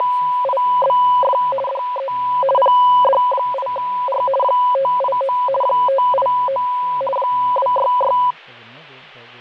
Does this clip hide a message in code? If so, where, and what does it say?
Yes: RTTY (50 baud, 450 Hz shift) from 0.0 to 8.3 s, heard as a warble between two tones, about 770 Hz centre, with fading and speech in English. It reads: … DE PD8R 589 589 266